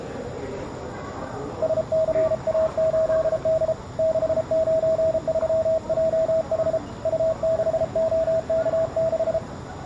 Morse code, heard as a keyed tone, hand-sent with a paddle, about 33 wpm, 640 Hz, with the noise of a crowd indoors. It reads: SCA8D 693JH U6OK6